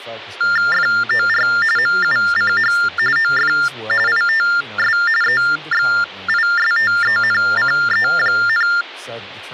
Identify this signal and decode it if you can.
TTY/TDD text telephone tones (45.45 baud Baudot), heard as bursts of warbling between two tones, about 400 Hz shift, 1600 Hz centre, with speech in English. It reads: FOR MUCH OF ITS EXISTENCE,